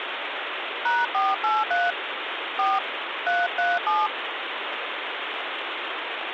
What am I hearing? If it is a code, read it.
DTMF, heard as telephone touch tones, dialled by hand, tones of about 200 ms, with phone line noise. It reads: #483 4 337